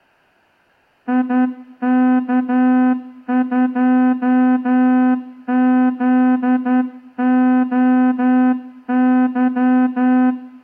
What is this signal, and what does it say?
Morse code, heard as a horn, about 11 wpm. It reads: IK2ZOY